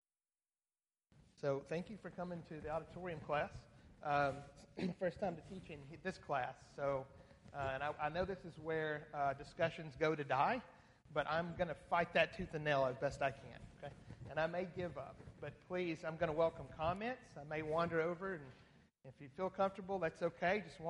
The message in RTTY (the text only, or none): none